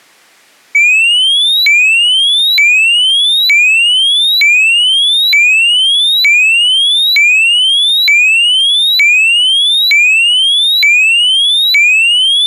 A tone that sweeps in pitch again and again. There is no code.